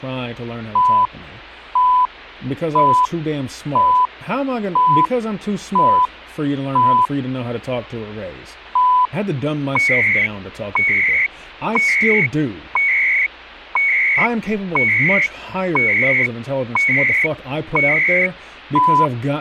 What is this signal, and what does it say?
Radio time signal (CHU, Canada), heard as beeps and data bursts, one a second, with speech in English.